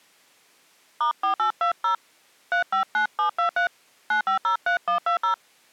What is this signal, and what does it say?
DTMF, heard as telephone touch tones, dialled by hand, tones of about 110 ms. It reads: *4820 359723 9503120